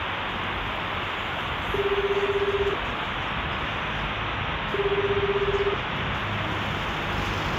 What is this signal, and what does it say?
Telephone call progress tone (Japanese plan), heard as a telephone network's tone, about 380, 400, 420 Hz, 1 s on and 2 s off, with phone line noise and street noise. Ringback tone.